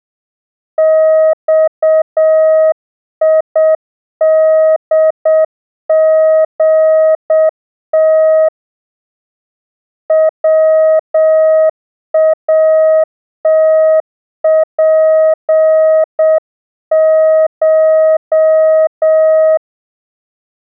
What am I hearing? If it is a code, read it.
Morse code (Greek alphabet), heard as a keyed tone, hand-sent with a paddle, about 7 wpm, 630 Hz. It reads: ΞΙΔΓΤ ΩΑΤΠΧ